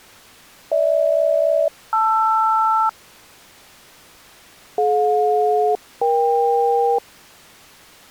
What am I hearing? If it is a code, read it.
Aircraft SELCAL, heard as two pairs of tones. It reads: GH-LR DJ-EK